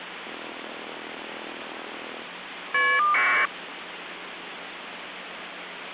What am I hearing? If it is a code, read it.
Caller ID data burst, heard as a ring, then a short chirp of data, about 1200 baud, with phone line noise.